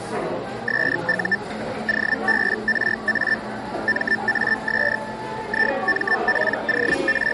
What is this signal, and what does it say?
Hellschreiber (Feld-Hell, 122.5 baud), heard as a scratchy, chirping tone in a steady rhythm, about 1800 Hz, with the noise of a cafe. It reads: SU OBRA MAS …